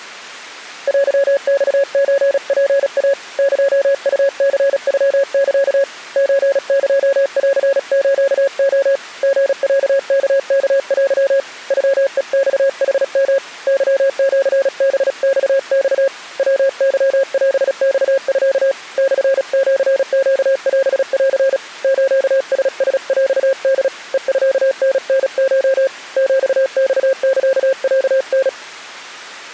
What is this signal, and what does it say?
Morse code (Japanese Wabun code), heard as a keyed tone, hand-sent with a paddle, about 36 wpm, 540 Hz. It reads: テマソツイ エウニノサ ソエンスレ リロワワテ ノヘマヌヨ ケシハママ ヤケオマミ モシネオン スララヰホ ヘミタタコ ヒマサロタ